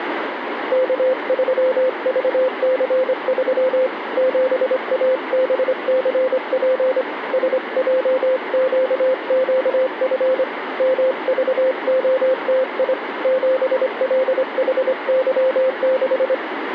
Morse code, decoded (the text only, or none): K3VC3 7ABCP SJQQF MVOTI 7LHY6